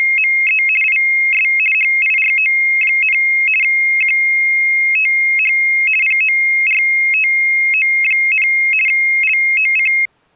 RTTY (50 baud, 450 Hz shift), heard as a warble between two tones, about 2350 Hz centre. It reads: … IS HIRO, QTH PORTO, LOC